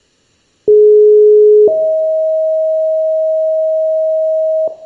Two-tone page, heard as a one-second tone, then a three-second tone, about 420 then 630 Hz, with room echo.